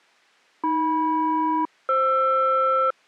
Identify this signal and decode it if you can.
Aircraft SELCAL, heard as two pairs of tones. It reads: AM-FR